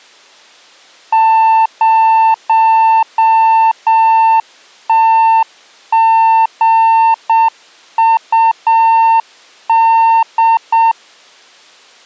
Morse code, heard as a keyed tone, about 7 wpm, 900 Hz. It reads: 0TGUD